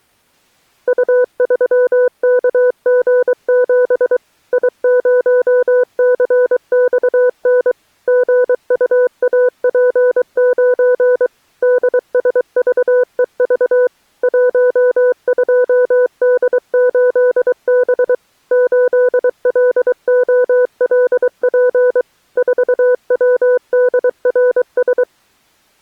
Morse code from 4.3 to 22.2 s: I0CXN GUAP9 DSVEV 12D8B 8LOLP

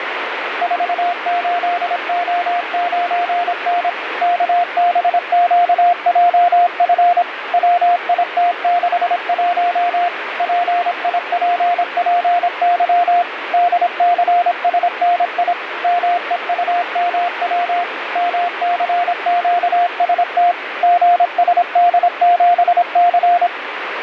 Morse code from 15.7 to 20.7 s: MEUMW MCQST

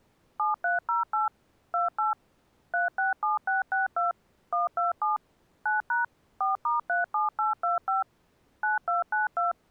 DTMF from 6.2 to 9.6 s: 4*37825 9292

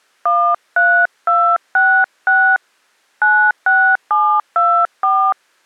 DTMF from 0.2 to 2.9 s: 13266

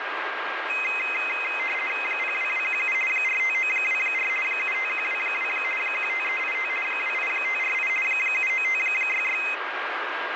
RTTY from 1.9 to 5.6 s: 02217 45924 75122

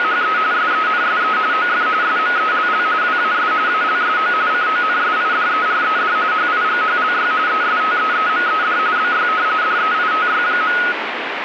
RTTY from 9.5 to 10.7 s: DEITY.

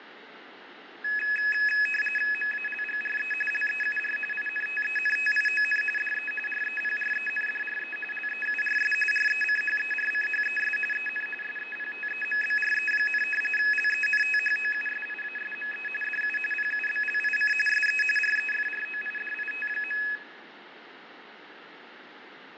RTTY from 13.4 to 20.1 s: LENTHOUSIASME DU PUBLIC SE REFROIDIT.

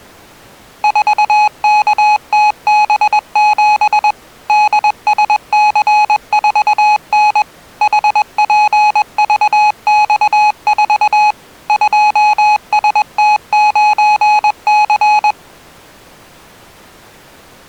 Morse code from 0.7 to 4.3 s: 4KTB7

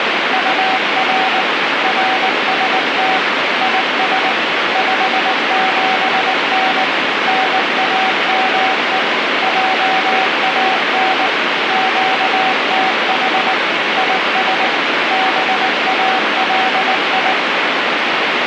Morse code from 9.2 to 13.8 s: JAN QTH

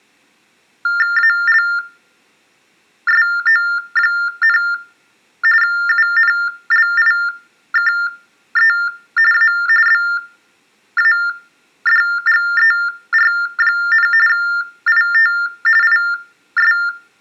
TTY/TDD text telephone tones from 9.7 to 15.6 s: BADGER, IT

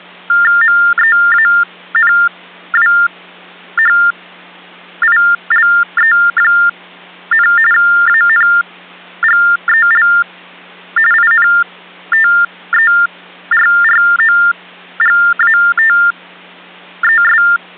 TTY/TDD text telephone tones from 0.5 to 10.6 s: MEANWHILE, ANGEL

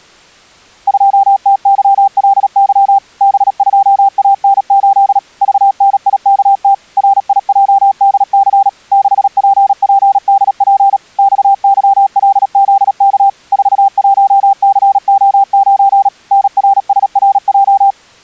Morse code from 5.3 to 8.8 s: VNIKT RIJDC

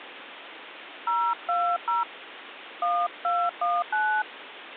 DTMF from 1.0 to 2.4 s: 020

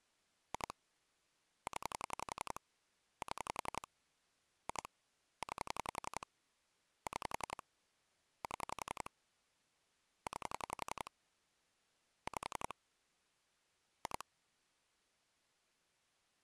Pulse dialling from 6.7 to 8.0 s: 6

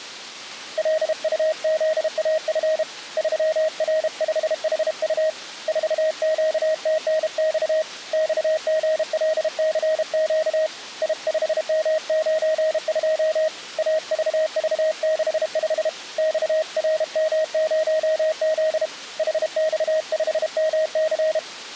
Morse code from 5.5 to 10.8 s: 4QTNX XGLCQ

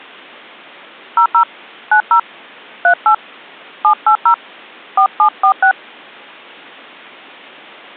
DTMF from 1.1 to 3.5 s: 00 90 38

